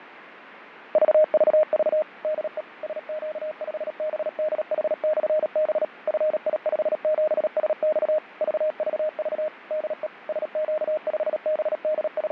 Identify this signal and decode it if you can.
Morse code, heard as a keyed tone, machine-sent, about 37 wpm, 620 Hz, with radio static and fading. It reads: VVV DE SQ5BDH/B FI57SX VVV DE …